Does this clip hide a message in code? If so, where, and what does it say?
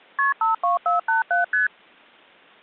Yes: multi-frequency trunk signalling (R1, as on North American trunks) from 0.2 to 1.7 s, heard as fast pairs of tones, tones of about 140 ms. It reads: KP 52487 ST